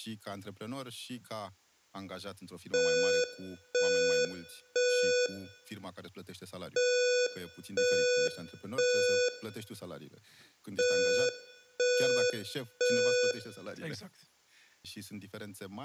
Alarm pattern, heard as an alarm's beeps, played three times, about 490 Hz, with room echo and speech in Romanian. Temporal three. Smoke or fire, evacuate.